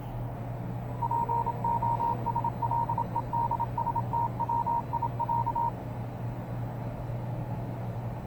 Morse code (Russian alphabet), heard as a keyed tone, machine-sent, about 27 wpm, 940 Hz, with the noise inside a lift. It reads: ПОСЛЕДСТВИЯ